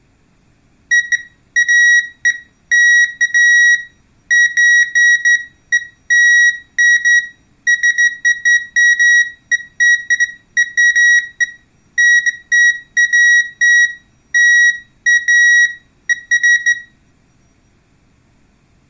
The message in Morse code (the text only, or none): none